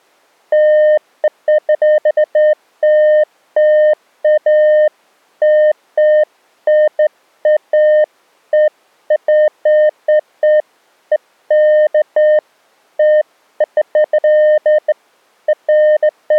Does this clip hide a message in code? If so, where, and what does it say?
No, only beeps of irregular length.